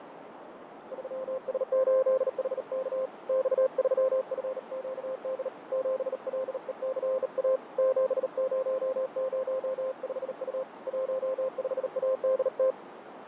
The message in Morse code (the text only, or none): 3S8HK X3FQD 7LECA 7005U 15ADT